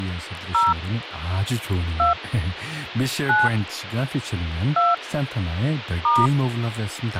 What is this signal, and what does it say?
DTMF, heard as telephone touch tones, dialled by hand, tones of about 170 ms, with phone line noise and speech in Korean. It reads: 0 2 9 2 *